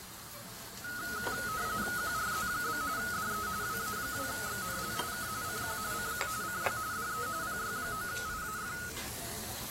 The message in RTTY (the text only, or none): QRZ? DE WA2XNL K CQ CQ CQ DE PY9IAF